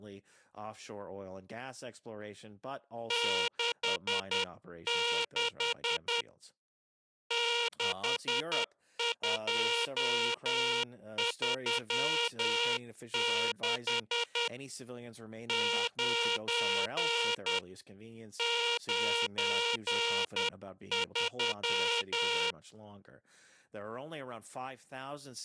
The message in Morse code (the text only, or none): 66 6236 9 93